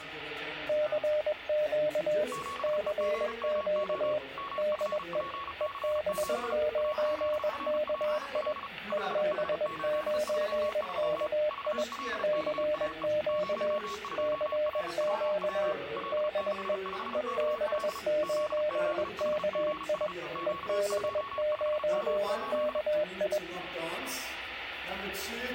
Morse code, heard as two keyed tones, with static crashes. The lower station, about 21 wpm, 600 Hz: CQ CQ DE EB9KI EB9KI CQ CQ DE EB9KI EB9KI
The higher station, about 35 wpm, 1110 Hz: 7EGMO MFPC7 AZRPL 5H833 VLKAE 02RWW L65KL ZZHGS Q25M8